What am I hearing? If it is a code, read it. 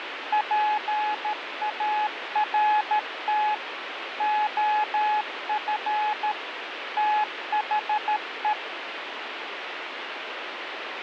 Morse code, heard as a keyed tone, machine-sent, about 13 wpm, 850 Hz, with radio static. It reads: PART OF THE